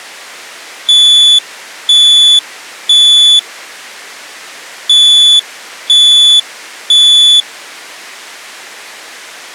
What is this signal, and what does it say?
Alarm pattern, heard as an alarm's beeps, played twice, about 3450 Hz. Temporal three. Smoke or fire, evacuate.